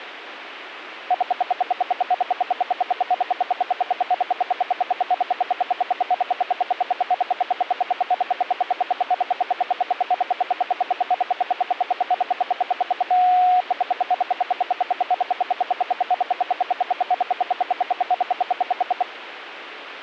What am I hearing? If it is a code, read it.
Radio time signal (RWM, Moscow), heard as ten pulses a second.